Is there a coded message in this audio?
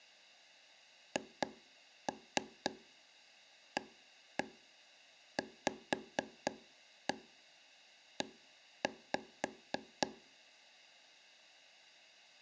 Yes: tap code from 1.2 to 10.1 s, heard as taps on a table, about 4 knocks a second. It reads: HAVE